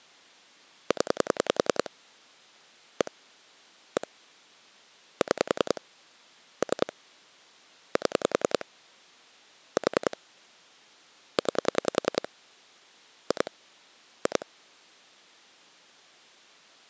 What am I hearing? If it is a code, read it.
Pulse dialling, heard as clicks on a phone line, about 10 pulses a second. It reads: 0 1 1 6 3 7 4 9 2 2